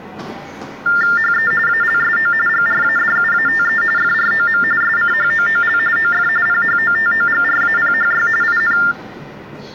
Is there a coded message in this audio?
Yes: TTY/TDD text telephone tones (45.45 baud Baudot) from 0.9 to 8.9 s, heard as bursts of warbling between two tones, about 400 Hz shift, 1600 Hz centre, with the noise of a subway station. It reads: HE ALSO GRADUATE FROM SCHOOL OF PHOTOGRAPHY IN